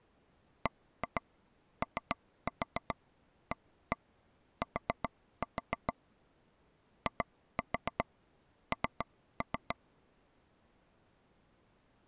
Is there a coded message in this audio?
Yes: tap code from 0.7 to 9.7 s, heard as taps on a table, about 7 knocks a second. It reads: BOAT IN